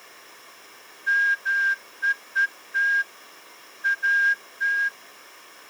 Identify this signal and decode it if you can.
Morse code, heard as a whistle, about 12 wpm. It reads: MEET AT